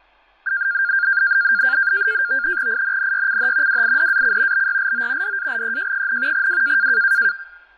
NAVTEX (SITOR-B), 100 baud, 170 Hz shift, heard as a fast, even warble, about 1500 Hz centre, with fading and speech in Bangla. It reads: INNYCH WIDAC BYLO DALEJ, W